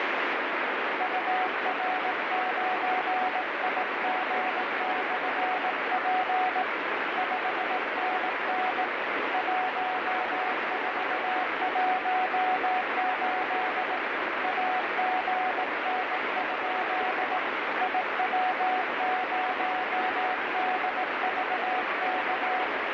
Morse code, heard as a keyed tone, hand-sent with a bug key, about 18 wpm, 740 Hz, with heavy radio static. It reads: UR9IG/P 5NN 1418 AGN? IW0DVK